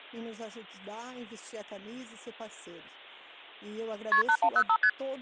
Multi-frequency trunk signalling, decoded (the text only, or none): KP 8105 ST